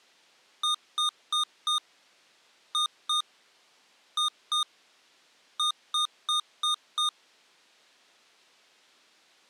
Beep code, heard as beeps from a small speaker, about 1220 Hz. 4-2-2-5.